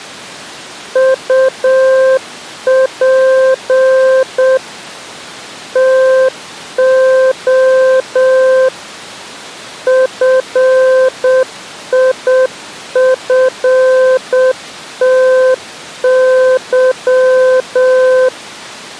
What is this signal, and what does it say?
Morse code, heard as a keyed tone, machine-sent, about 7 wpm, 520 Hz. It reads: UP TO FIFTY